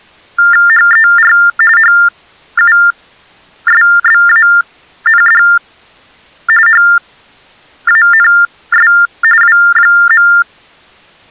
TTY/TDD text telephone tones (45.45 baud Baudot), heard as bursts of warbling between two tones, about 400 Hz shift, 1600 Hz centre. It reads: HER HUSBAND HANS W.